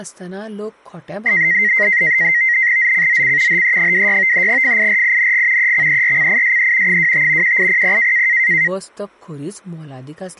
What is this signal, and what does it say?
NAVTEX (SITOR-B), 100 baud, 170 Hz shift, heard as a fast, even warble, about 2000 Hz centre, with speech in Goan Konkani. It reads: ZCZC HE26 FIRING EXERCISE 25 1800